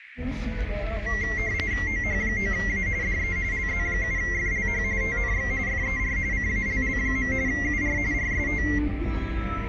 RTTY (45.45 baud, 170 Hz shift), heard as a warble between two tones, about 2050 Hz centre, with radio static, a narrow filter and the noise inside a car. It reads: OH9A DE LZ7FLH TNX FER CALL. UR RST